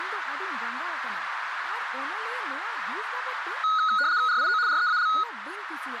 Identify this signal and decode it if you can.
RTTY (75 baud, 170 Hz shift), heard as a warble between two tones, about 1360 Hz centre, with radio static, a narrow filter and speech in Santali. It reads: RIO REAL